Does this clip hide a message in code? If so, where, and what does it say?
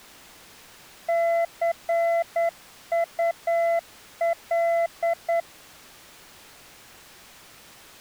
Yes: Morse code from 1.0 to 5.5 s, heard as a keyed tone, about 9 wpm, 680 Hz. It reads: CUL